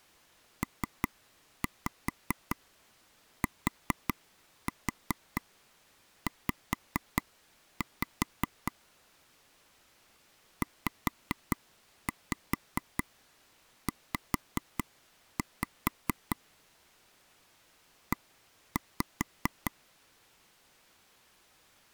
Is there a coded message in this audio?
Yes: tap code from 0.6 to 19.7 s, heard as taps on a table, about 4 knocks a second. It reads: PTZ ZZ E